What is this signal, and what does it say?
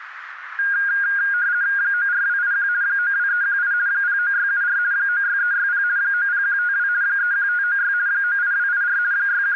RTTY (50 baud, 170 Hz shift), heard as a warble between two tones, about 1550 Hz centre, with radio static. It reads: 94281 92318 09674 96360 90152 31596 98284 …